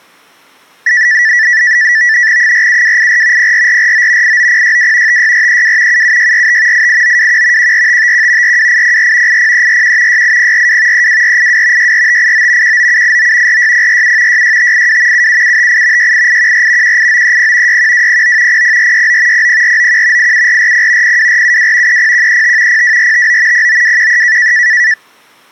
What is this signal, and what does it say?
NAVTEX (SITOR-B), 100 baud, 170 Hz shift, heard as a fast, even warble, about 1850 Hz centre. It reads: 47284 04449 89062 56432 77645 88921 14551 42804 80341 68042 32482 64589 19789 46047 66582 77758 68814 18930 61209 00469 00491 87440 02472 30135 02459 09213